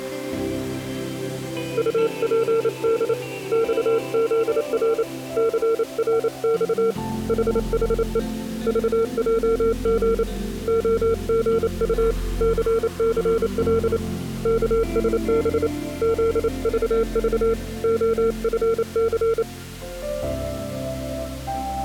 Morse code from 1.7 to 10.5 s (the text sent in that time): UPD XZR CRX HHE VJG